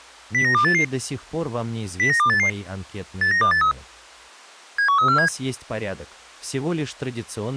Five-tone selective call (CCIR), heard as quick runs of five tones, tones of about 100 ms. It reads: 09288 09288 89283 71347